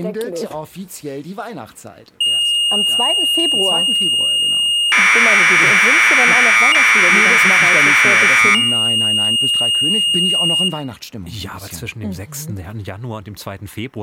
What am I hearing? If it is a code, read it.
Commodore tape loading (standard loader), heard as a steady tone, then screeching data, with room echo.